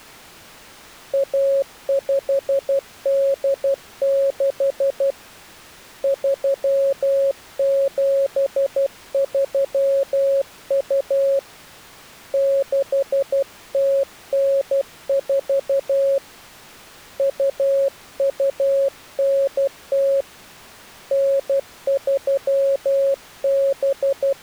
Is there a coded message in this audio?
Yes: Morse code (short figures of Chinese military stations) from 1.1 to 24.4 s, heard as a keyed tone, hand-sent with a paddle, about 12 wpm, 550 Hz. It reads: 1586 3732 6094 2290 …